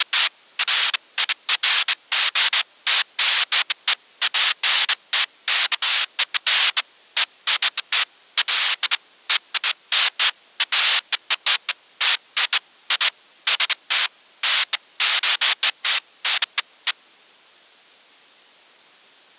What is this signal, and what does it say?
Bursts of noise. There is no code.